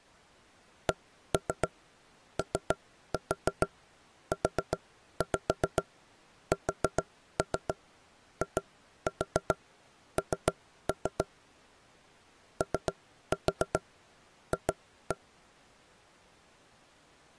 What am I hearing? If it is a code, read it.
Tap code, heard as knocks on wood, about 7 knocks a second. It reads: COUSIN OF